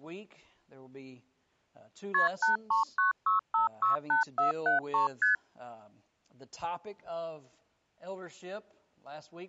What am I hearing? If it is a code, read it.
Multi-frequency trunk signalling (R1, as on North American trunks), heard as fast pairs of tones, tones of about 130 ms. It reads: KP 8396568473 ST